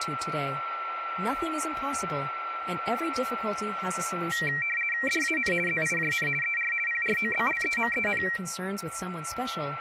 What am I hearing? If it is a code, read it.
RTTY (50 baud, 450 Hz shift), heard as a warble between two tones, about 2100 Hz centre, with a steady whistle near 1350 Hz and speech in English. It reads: DAN ZIJN ER PROBLEMEN